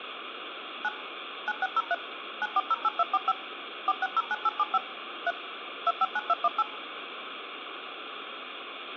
DTMF, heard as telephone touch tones, dialled by machine, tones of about 40 ms, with phone line noise. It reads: 9 9603 9408245 4609875 3 259218